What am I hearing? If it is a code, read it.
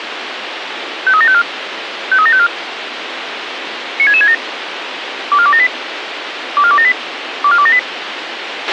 Five-tone selective call (ZVEI), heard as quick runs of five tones, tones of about 70 ms, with radio hiss and a squelch burst at the end. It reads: 53754 53754 96667 24278 24278 24278